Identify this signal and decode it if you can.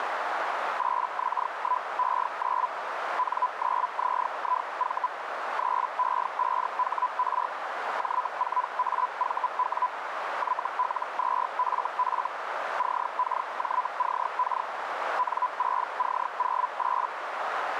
Hellschreiber (Feld-Hell, 122.5 baud), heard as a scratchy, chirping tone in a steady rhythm, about 1000 Hz, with radio static and a narrow filter. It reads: 8X1E9 N9ZIV 3E5HR J4AVW YL2FF CKJCK N6C08